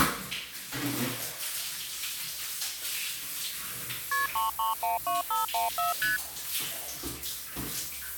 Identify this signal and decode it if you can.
Multi-frequency trunk signalling (R1, as on North American trunks), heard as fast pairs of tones, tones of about 150 ms, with the noise of a restroom. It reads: KP 3312514 ST